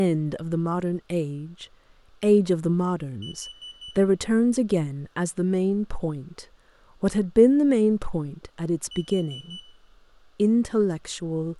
Alarm pattern, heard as an alarm's beeps, played twice, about 3000 Hz, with room echo and speech in English. Temporal four. Carbon monoxide.